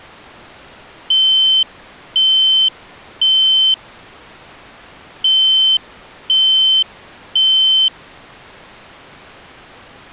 Alarm pattern, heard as an alarm's beeps, played twice, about 3100 Hz. Temporal three. Smoke or fire, evacuate.